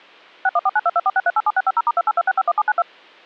DTMF, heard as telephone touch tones, dialled by machine, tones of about 40 ms. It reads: 61492246387650*282651792